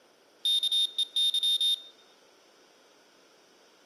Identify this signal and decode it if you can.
Morse code, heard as a high beeper, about 27 wpm, 3650 Hz. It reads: KEY